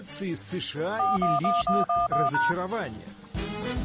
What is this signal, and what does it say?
DTMF, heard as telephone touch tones, dialled by machine, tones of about 180 ms. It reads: 411111#